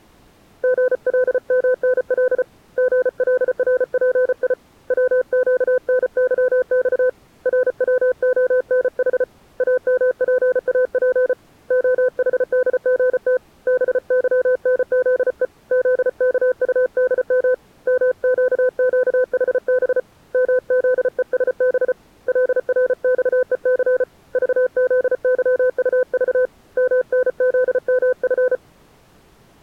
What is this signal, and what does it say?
Morse code, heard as a keyed tone, hand-sent with a paddle, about 34 wpm, 510 Hz. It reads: GLMNL GLRPI WQNYX RWONH AMPAP OHDGT BYNZE ZKUDM MQQHB MZESB LRXEC VZYUV MNZMF